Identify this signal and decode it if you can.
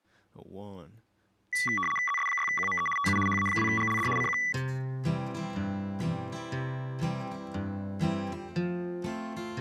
RTTY (75 baud, 850 Hz shift), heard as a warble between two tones, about 1550 Hz centre. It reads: ZS6QME TU HA2GLD CQ